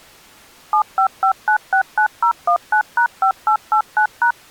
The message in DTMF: 755969019#5889#

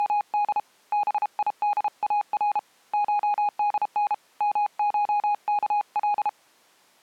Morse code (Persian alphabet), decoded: … بیدار شدن مشکل

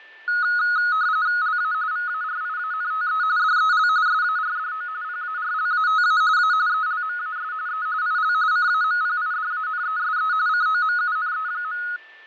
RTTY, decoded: LA VARIANTE DEL SARDO PARLATA A ELMAS E IL CAMPIDANESE COMUNE.

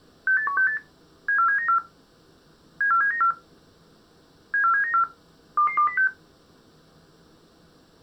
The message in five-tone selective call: 68168 74794 74794 74794 22206

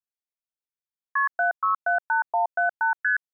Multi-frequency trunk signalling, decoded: KP 7678178 ST

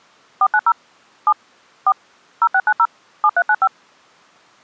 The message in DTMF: 490 7 4 0690 7395

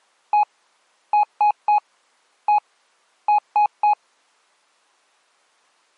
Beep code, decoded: 1-3-1-3

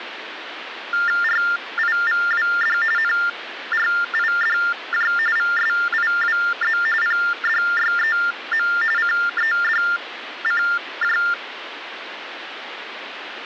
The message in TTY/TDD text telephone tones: RIVWD NRIDJ VSIWZ PDYEM CEDCJ

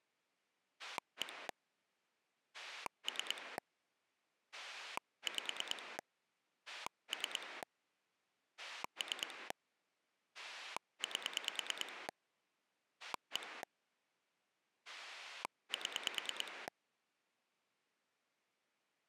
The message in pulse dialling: 1 3 5 3 3 8 1 7

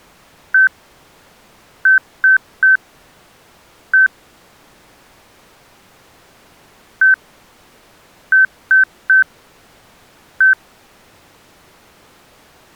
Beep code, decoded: 1-3-1

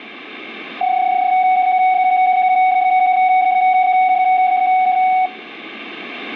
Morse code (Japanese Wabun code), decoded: none

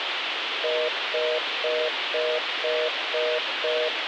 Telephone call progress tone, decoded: congestion tone

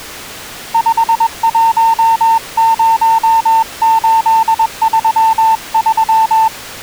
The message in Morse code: 510833

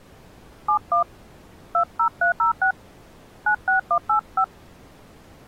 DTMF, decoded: 71 20306 96185

